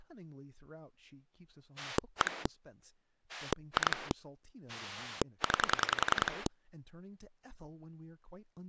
Pulse dialling, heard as a rotary dial, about 10 pulses a second, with speech in English. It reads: 1 2 9